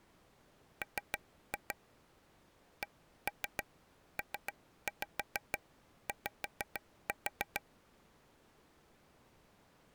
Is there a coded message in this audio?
Yes: tap code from 0.8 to 7.6 s, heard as taps on a table, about 6 knocks a second. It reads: M CPY